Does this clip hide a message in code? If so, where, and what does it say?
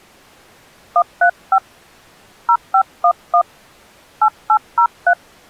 Yes: DTMF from 1.0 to 5.1 s, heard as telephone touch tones, dialled by hand, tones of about 80 ms. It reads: 135 0511 8803